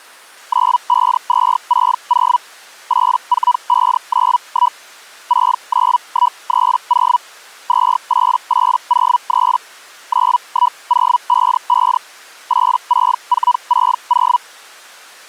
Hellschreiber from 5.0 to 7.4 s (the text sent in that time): 69130